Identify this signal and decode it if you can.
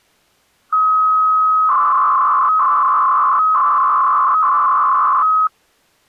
300-baud modem data (Bell 103 tones), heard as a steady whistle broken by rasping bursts, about 300 baud, 200 Hz shift.